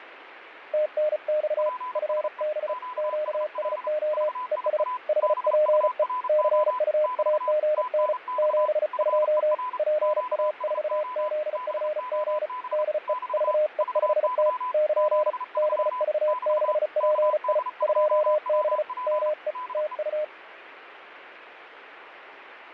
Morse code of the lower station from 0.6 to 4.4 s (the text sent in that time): TNX FB QSO